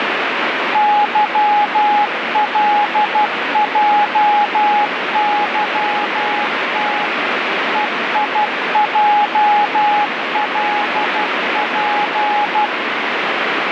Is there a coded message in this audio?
Yes: Morse code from 0.7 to 12.7 s, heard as a keyed tone, machine-sent, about 12 wpm, 830 Hz, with heavy radio static. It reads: YLJYT EIJLP